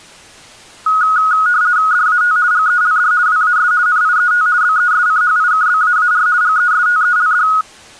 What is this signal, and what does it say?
RTTY (50 baud, 170 Hz shift), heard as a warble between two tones, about 1360 Hz centre. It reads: DAT GELD WAS NIET BESCHIKBAAR GESTELD